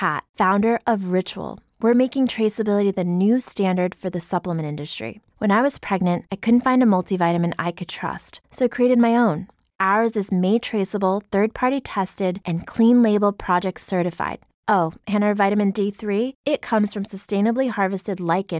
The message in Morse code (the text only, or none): none